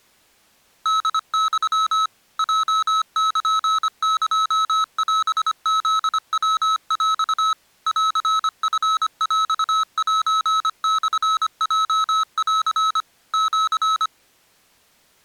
Morse code (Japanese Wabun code), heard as electronic beeps, machine-sent, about 25 wpm, 1290 Hz. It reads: ホユ ヲルエオフヤヰ ンチヰセモヲン シ